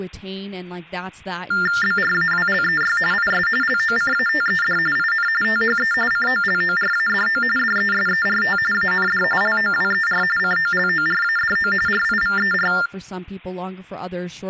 TTY/TDD text telephone tones (45.45 baud Baudot), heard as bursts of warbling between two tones, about 400 Hz shift, 1600 Hz centre, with speech in English. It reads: BRAWLEY IS LOCATED IN THE COLORADO DESERT AND LOWER COLORADO RIVER